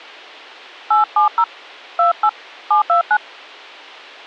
DTMF, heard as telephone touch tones, dialled by hand, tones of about 100 ms, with a squelch burst at the end. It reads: 870 28 729